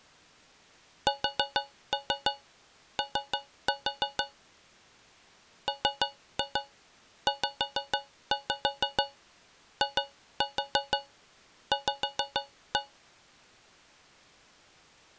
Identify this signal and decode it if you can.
Tap code, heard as taps on a metal pipe, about 6 knocks a second. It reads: SO MZIV